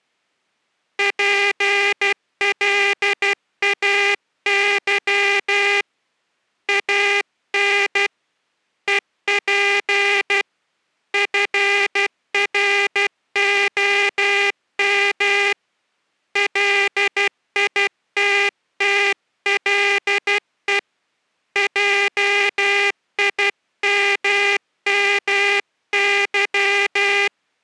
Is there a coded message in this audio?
Yes: Morse code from 0.9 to 27.3 s, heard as a buzzer, hand-sent with a paddle, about 12 wpm. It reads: PLAY AN EP FROM LITTLE JIMMY